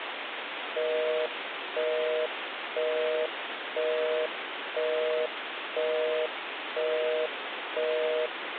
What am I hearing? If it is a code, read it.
Telephone call progress tone (North American plan), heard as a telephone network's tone, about 480, 620 Hz, 0.5 s on and 0.5 s off, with phone line noise. Busy tone.